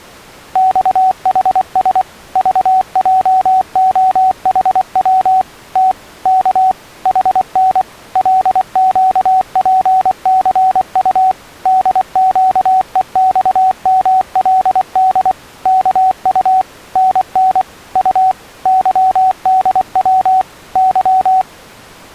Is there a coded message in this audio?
Yes: Morse code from 0.5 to 21.5 s, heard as a keyed tone, machine-sent, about 24 wpm, 750 Hz. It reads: XHS VJOHW T K HN LQPCU DQEXMLD KU NN U YDW Y